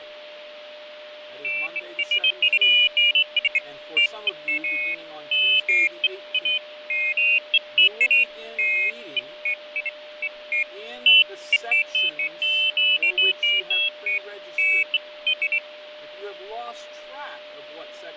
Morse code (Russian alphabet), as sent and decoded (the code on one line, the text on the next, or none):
none